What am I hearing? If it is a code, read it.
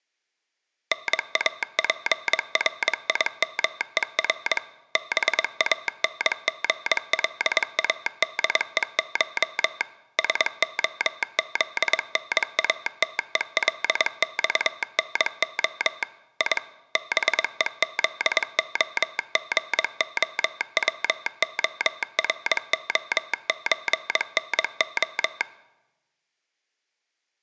Morse code (Russian alphabet), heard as a telegraph sounder, machine-sent, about 22 wpm. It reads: НАПРИМЕР БАНГЛАДЕШ СОЗНАТЕЛЬНО И БЕЗОГОВОРОЧНО